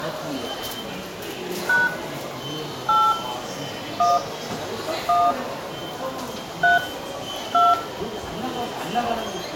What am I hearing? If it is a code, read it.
DTMF, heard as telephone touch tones, dialled by hand, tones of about 200 ms, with room echo and the noise of a subway station. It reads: # 8 1 1 3 2